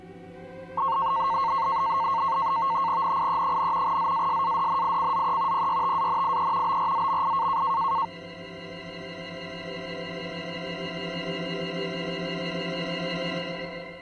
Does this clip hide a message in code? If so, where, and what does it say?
Yes: NAVTEX (SITOR-B), 100 baud, 170 Hz shift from 0.8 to 8.1 s, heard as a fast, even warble, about 1000 Hz centre. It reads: NIE, ZASADNICZE PYTANIE BRZMI